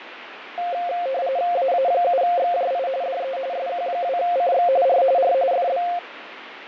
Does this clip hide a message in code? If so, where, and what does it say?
Yes: RTTY (45.45 baud, 170 Hz shift) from 0.6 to 6.0 s, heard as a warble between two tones, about 620 Hz centre, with radio static and fading. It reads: AA7XJI DE SQ2CX R R FB